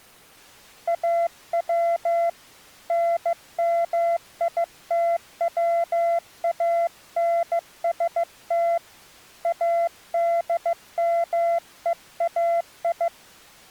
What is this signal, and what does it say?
Morse code (Persian alphabet), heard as a keyed tone, hand-sent with a bug key, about 15 wpm, 680 Hz. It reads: او نمیتوانست ادمهای